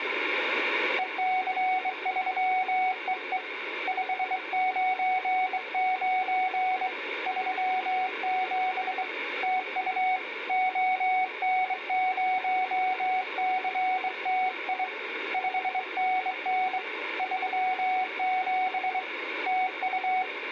Morse code, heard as a keyed tone, hand-sent with a straight key, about 23 wpm, 750 Hz. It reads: EC3EE 599 37 TU ON0CTI 5NN 37 TU